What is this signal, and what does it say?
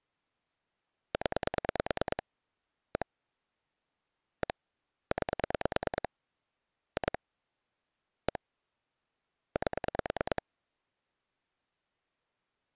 Pulse dialling, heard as clicks on a phone line, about 9 pulses a second. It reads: 0 1 1 9 2 1 8